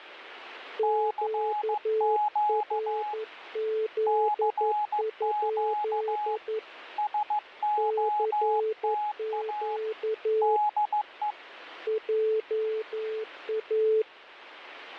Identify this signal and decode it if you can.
Morse code, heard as two keyed tones, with radio static. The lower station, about 11 wpm, 440 Hz: QRZ? CQ JA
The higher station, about 15 wpm, 840 Hz: CQ CQ SOTA DE